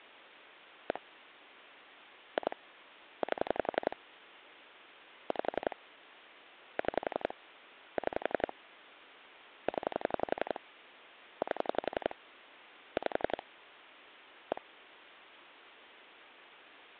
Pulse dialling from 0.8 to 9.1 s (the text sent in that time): 1 2 8 5 6 6